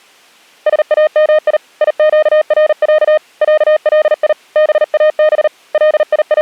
Morse code (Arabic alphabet), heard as a keyed tone, hand-sent with a paddle, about 39 wpm, 620 Hz. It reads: سامي يقرع علي باب …